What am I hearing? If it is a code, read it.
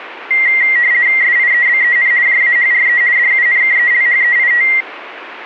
RTTY (50 baud, 170 Hz shift), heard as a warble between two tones, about 2000 Hz centre. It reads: SIEBEN JAHRE DUNKELHEIT